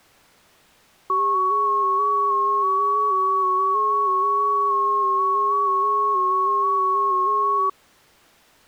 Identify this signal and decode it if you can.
FT8 (several signals at once), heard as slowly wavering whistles, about 6.25 baud.